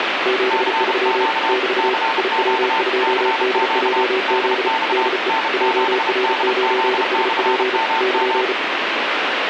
Morse code, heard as two keyed tones, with heavy radio static. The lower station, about 35 wpm, 380 Hz: 73 <BT> IW2DJZ DE JR9SP <KN>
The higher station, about 32 wpm, 900 Hz: CQ CQ CQ DX N7DZ/MM